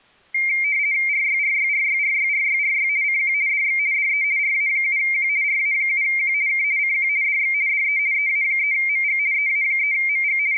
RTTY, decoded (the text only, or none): RYRYRYRYRYRY CQ DX DE RA7Q RA7Q K CQ DX DE EA3MG EA3MG …